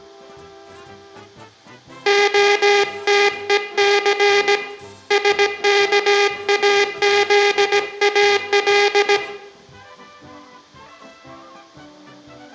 Morse code (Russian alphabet), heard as a buzzer, hand-sent with a paddle, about 17 wpm, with room echo. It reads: ОТЕЦ СКАЗАЛ